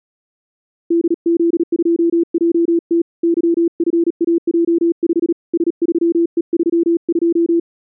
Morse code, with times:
0.9-3.0 DZ2JT
3.2-5.3 YFAJ5
5.5-7.6 S3E32

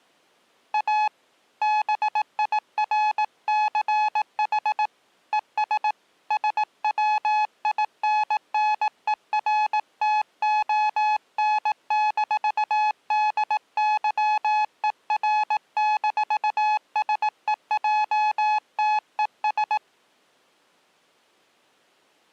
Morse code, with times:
0.7-1.1 A
1.6-4.9 BIRCH
5.3-5.9 ES
6.3-19.8 SWINNERTON-DYER-SEJTES

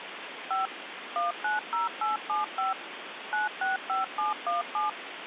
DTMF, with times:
0.5-0.7 5
1.2-2.7 190875
3.3-4.9 965717

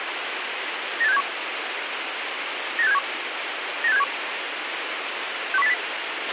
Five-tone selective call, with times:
1.0-1.2 98671
2.8-3.0 98671
3.8-4.0 98671
5.5-5.7 61080

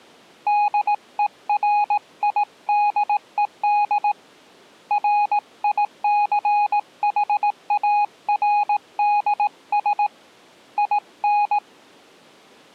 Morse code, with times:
0.5-4.1 DERIDED
4.9-10.1 RICHARDS
10.8-11.6 IN

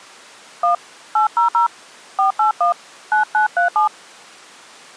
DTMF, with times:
0.6-0.7 1
1.2-1.7 800
2.2-2.7 481
3.1-3.9 9937

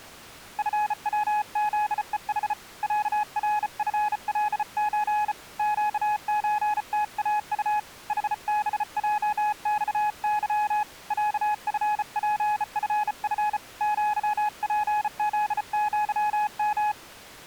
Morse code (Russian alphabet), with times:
0.6-2.5 ФВЗЕХ
2.8-5.3 ЯРФЛЧ
5.6-7.8 ЩЧТАУ
8.1-10.8 ХБЙЬЫ
11.1-13.6 ЯФПФФ
13.8-16.9 ЪПЗЪМ

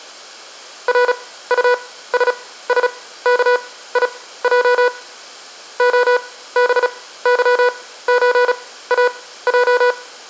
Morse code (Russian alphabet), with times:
0.9-4.9 РУССКИЙ
5.8-9.9 ОБЫЧАЙ

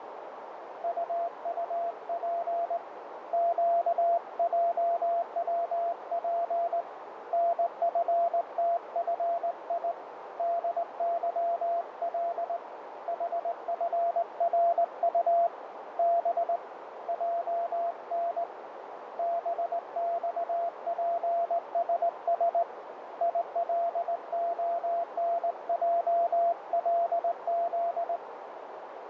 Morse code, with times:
0.8-2.8 UUP
3.3-6.8 QJWP
7.3-9.9 NFTFI
10.4-12.6 DYL
13.1-15.5 HFRU
16.0-16.6 B
17.1-18.4 JN
19.2-22.6 BXPSS
23.2-28.2 ILONJLZ

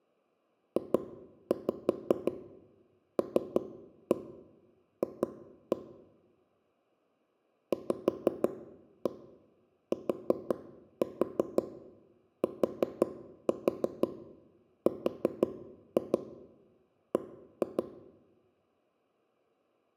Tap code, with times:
0.8-5.8 JLF
7.7-17.8 VTTRB

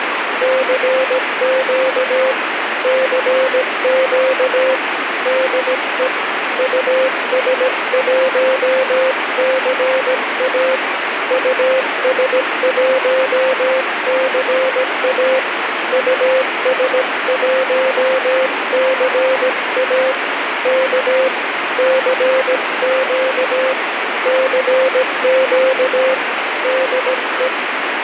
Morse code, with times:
0.4-2.3 CQ
2.8-4.7 CQ
5.3-6.1 DE
6.6-10.8 US1CA
11.3-15.4 US1CA
15.9-20.1 US1CA
20.7-21.3 K
21.8-23.7 CQ
24.3-26.1 CQ
26.6-27.5 DE

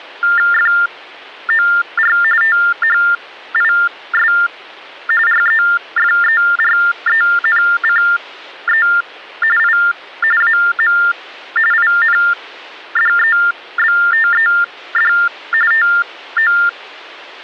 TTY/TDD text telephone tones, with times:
0.5-2.2 FOR
2.4-4.3 THIS
5.3-8.9 REFERENCE
9.6-9.8 I
10.4-11.0 AM
11.7-15.1 INDEBTED
15.7-16.5 TO

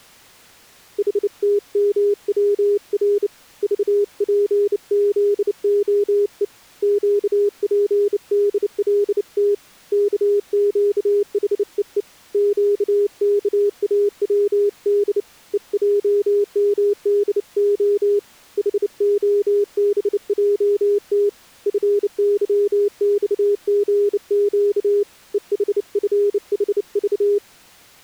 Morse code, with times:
1.0-3.3 HTMWR
3.6-6.4 VPZOE
6.8-9.5 QPDLT
9.9-12.0 KQHEE
12.3-15.2 QKAWD
15.5-18.2 EJMDO
18.6-21.3 HOBJT
21.7-25.0 FYXGQ
25.3-27.4 EHFHV

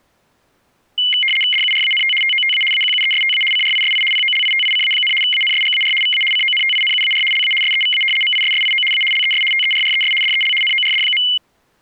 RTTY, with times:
1.5-2.1 DURANT
2.2-2.6 TOTA
2.7-3.4 AQUESTA
3.5-4.0 CRISI
4.1-5.1 POLITICA,
5.2-5.9 ANSGAR
6.0-6.2 VA
6.3-7.2 CONTINUAR
7.3-7.5 LA
7.6-8.0 SEVA
8.2-8.8 MISSIO
8.9-9.0 A
9.1-9.4 LES
9.5-10.1 TERRES
10.2-10.5 DEL
10.6-11.2 NORD.

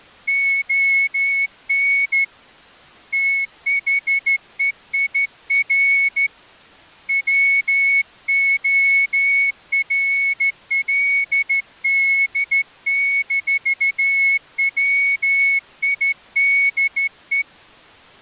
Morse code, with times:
0.3-2.2 ON
3.1-6.3 THEIR
7.1-17.4 WORLD-WIDE

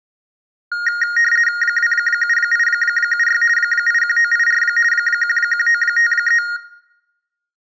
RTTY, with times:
1.6-3.4 27876
3.6-4.6 81984
4.9-6.4 11953

